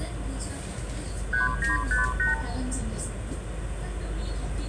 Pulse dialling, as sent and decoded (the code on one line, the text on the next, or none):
none